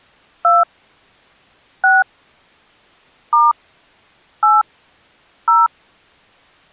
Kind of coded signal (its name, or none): DTMF